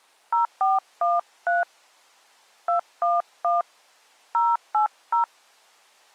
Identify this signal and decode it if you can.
DTMF, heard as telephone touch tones, dialled by hand, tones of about 150 ms. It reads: 0413 211 080